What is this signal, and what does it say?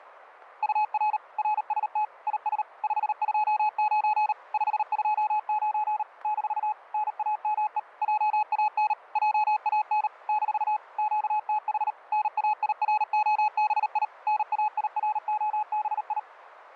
Morse code, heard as a keyed tone, machine-sent, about 38 wpm, 850 Hz. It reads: UR RST IS 529 529 - NAME JAN JAN - QTH NAIROBI NAIROBI